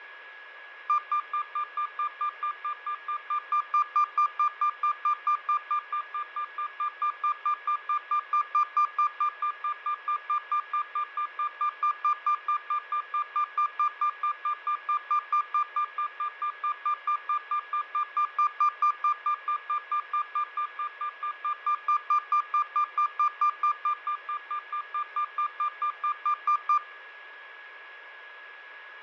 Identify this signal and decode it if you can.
Evenly repeated beeps, with radio static, fading and a steady whistle near 1670 Hz. There is no code.